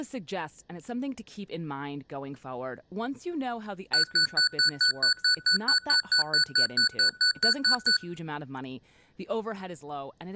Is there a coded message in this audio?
No, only evenly repeated beeps, with room echo and speech in English.